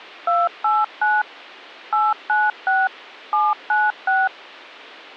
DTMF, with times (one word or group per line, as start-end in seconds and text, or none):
0.3-1.2 289
1.9-2.9 896
3.3-4.3 796